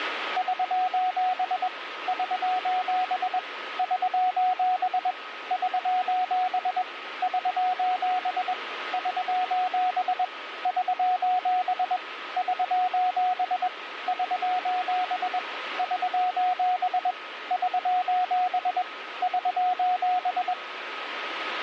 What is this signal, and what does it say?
Morse code, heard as a keyed tone, machine-sent, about 21 wpm, 730 Hz, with radio static and a steady whistle near 1270 Hz. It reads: <SOS> <SOS> <SOS> <SOS> <SOS> <SOS> <SOS> <SOS> <SOS> <SOS> <SOS> <SOS>